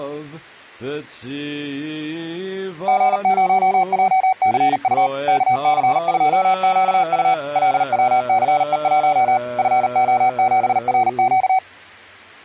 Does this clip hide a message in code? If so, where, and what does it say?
Yes: Morse code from 2.8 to 11.6 s, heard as a keyed tone, machine-sent, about 39 wpm, 760 Hz. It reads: G0JCU KC2QU LWCE1 FO7RQ